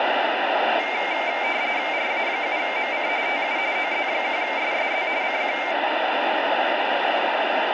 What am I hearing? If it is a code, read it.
RTTY (45.45 baud, 170 Hz shift), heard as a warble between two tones, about 2200 Hz centre, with radio static. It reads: RA7MC TU OZ1SSZ CQ